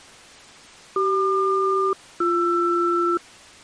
Aircraft SELCAL, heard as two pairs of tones. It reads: CQ-BR